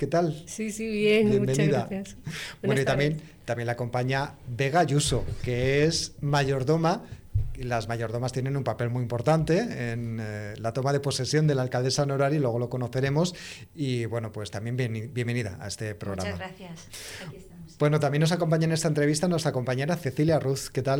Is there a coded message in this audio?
No.